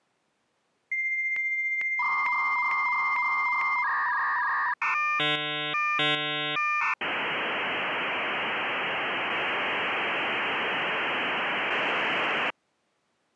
Dial-up modem handshake (V.34 or later), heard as a whistle, warbles, then hiss.